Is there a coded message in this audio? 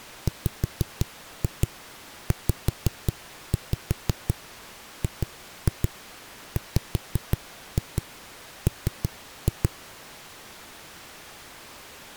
Yes: tap code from 0.3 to 9.7 s, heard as knocks on a wall, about 5 knocks a second. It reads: WZGWM